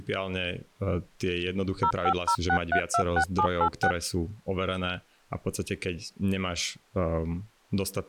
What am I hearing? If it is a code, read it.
DTMF, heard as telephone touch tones, dialled by machine, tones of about 80 ms, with speech in Slovak. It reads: 0506326786